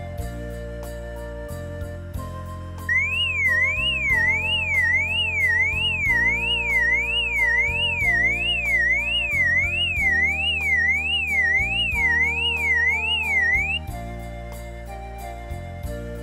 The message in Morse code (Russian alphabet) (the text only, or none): none